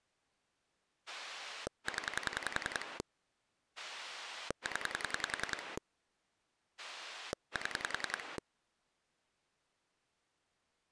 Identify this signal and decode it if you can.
Pulse dialling, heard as a rotary dial, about 10 pulses a second. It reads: 0 0 7